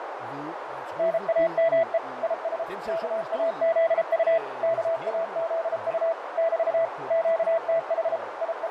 Morse code, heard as a keyed tone, machine-sent, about 33 wpm, 660 Hz, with radio static, fading, a narrow filter and speech in Danish. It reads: NAME IS KAZU KAZU <BT> QTH …